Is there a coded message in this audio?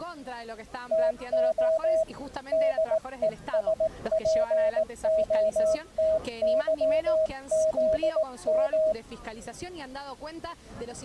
Yes: Morse code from 0.9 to 9.0 s, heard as a keyed tone, hand-sent with a paddle, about 18 wpm, 640 Hz. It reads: TO DESPOTYZM